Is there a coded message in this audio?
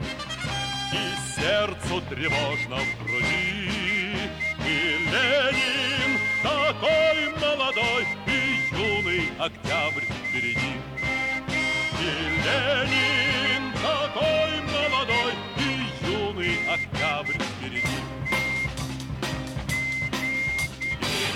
Yes: Morse code (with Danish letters) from 2.2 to 21.4 s, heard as a whistle, hand-sent with a straight key, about 9 wpm. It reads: VELKOMMEN I DET …